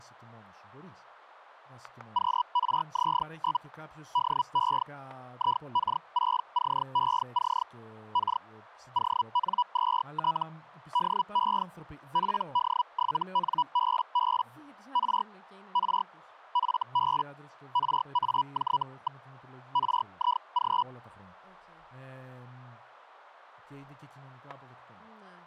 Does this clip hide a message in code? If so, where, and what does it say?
Yes: Hellschreiber (Feld-Hell, 122.5 baud) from 2.1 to 20.8 s, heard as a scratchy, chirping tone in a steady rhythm, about 980 Hz, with static crashes and speech in Greek. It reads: QRZ? DE IK6CEC K ON2T DE PD7NBB R R FB RAJ. RIG